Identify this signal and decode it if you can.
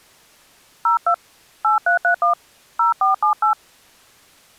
DTMF, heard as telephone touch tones, dialled by hand, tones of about 110 ms. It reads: 02 8331 0478